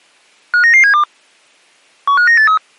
Five-tone selective call (CCIR), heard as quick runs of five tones, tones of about 100 ms. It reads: 59972 15983